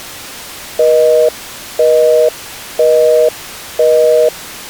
Telephone call progress tone (North American plan), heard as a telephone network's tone, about 480, 620 Hz, 0.5 s on and 0.5 s off. Busy tone.